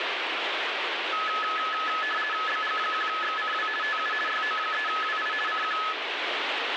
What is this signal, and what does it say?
RTTY (50 baud, 450 Hz shift), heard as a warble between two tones, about 1500 Hz centre, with radio static. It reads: BG1XCW TU YO3WI CQ